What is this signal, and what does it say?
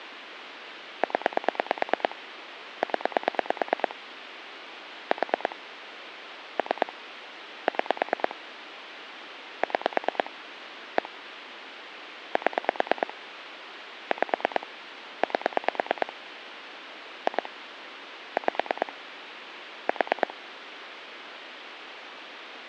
Pulse dialling, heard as clicks on a phone line, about 9 pulses a second, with phone line noise. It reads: 0 0 4 3 6 6 1 7 5 8 2 5 4